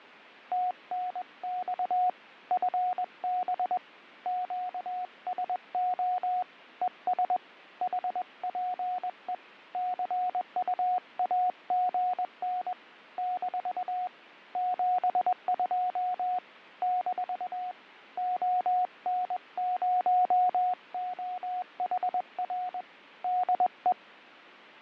Morse code, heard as a keyed tone, hand-sent with a paddle, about 21 wpm, 730 Hz, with fading. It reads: TNX FB QSO ES HPE CUAGN - 72 - ON0OHR DE